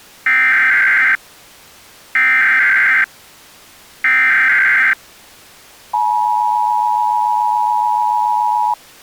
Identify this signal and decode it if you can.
Emergency Alert System (SAME) tones (header bursts, then the 853 and 960 Hz attention tone), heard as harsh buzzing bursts, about 520.83 baud.